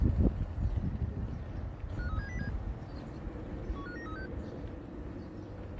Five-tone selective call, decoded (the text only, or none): 53707 15936